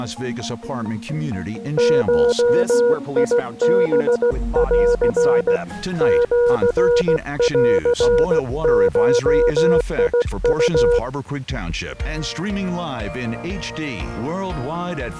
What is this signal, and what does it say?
Morse code (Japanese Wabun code), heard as a keyed tone, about 16 wpm, 480 Hz. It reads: ゴハン シンゴウ